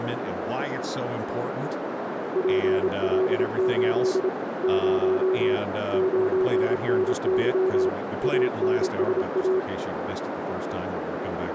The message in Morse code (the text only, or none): PL8 0 9NY ANSA